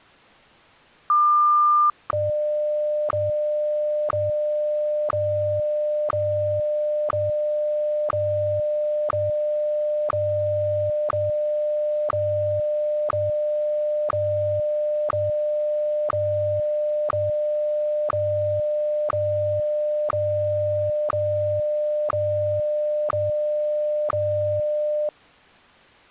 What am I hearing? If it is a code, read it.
Radio time signal (WWVH, Hawaii), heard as ticks, one a second.